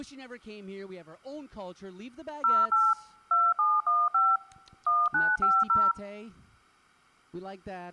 DTMF, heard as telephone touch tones, dialled by machine, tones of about 220 ms, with speech in English. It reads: 08 2715 1950